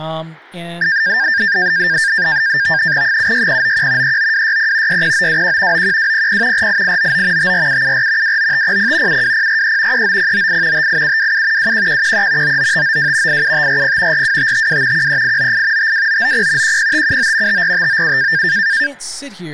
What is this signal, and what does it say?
NAVTEX (SITOR-B), 100 baud, 170 Hz shift, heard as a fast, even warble, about 1700 Hz centre, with speech in English. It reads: 76091 39260 60921 91200 48899 54774 29500 72043 39098 58727 21113 99592 87540 42552 13898 52990 10579 54597